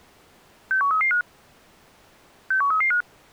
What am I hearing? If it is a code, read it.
Five-tone selective call (CCIR), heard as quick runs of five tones, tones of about 100 ms. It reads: 61335 61335